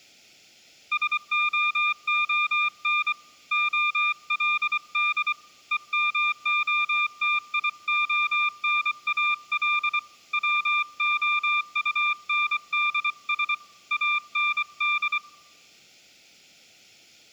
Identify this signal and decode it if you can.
Morse code, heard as a keyed tone, hand-sent with a paddle, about 24 wpm, 1200 Hz, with room echo. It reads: SOON OLD EMOTIONAL WOUNDS AND